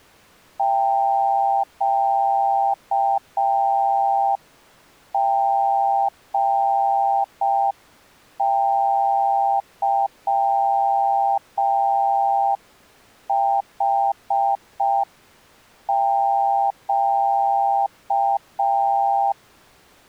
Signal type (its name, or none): Morse code